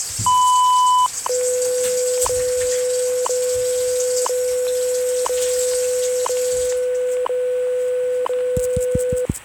Radio time signal (WWV, Colorado), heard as ticks, one a second, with static crashes and kitchen noise.